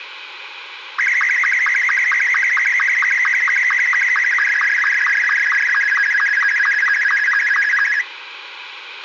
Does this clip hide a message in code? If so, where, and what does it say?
Yes: SSTV (slow-scan television), Martin M2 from 1.0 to 8.0 s, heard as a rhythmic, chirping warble, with radio hiss and a squelch burst at the end.